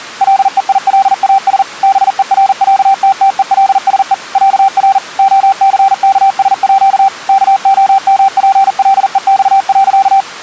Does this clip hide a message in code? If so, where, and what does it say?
Yes: Morse code (with Swedish letters) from 0.2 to 10.3 s, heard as a keyed tone, machine-sent, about 40 wpm, 780 Hz. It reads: LEILAS BERÄTTELSE ÄR OCKSÅ KOMPLEX.